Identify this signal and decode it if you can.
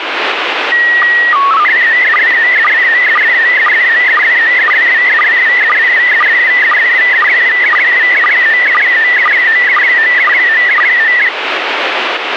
SSTV (slow-scan television), PD 120, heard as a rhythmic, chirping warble, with radio static.